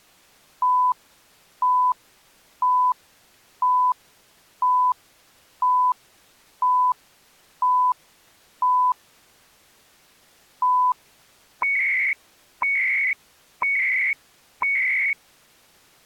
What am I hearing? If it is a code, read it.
Radio time signal (CHU, Canada), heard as beeps and data bursts, one a second.